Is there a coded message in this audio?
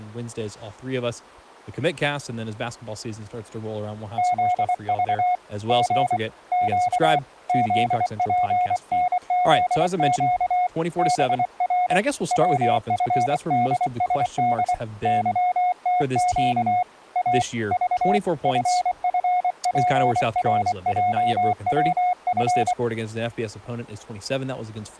Yes: Morse code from 4.1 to 22.8 s, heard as a keyed tone, hand-sent with a paddle, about 24 wpm, 720 Hz, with speech in English. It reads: ZV G Q ZPNZQ BR WFDSD YTQ A V FFPRJWF